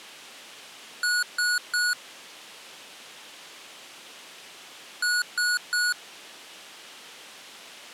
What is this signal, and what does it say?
Beep code, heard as beeps from a small speaker, played twice, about 1460 Hz. 3 short. In AMI BIOS tables: failure in the first 64 KB of memory; in Dell tables: chipset error.